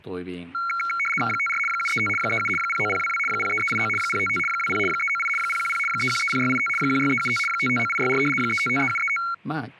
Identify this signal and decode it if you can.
RTTY (75 baud, 850 Hz shift), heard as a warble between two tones, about 1800 Hz centre, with speech in Japanese. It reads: 54 735 37 09022 03389 055 20 398 010 3130685 16375 559864 3553735